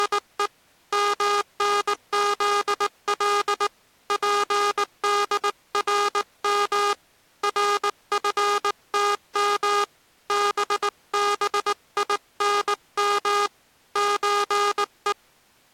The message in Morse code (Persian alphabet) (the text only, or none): … منزل پدرم رفتم ببینم چه